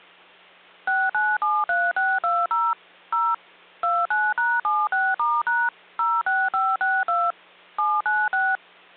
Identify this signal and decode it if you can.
DTMF, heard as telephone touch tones, dialled by machine, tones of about 220 ms, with hum. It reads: 6973620 0 29#76*# 06562 796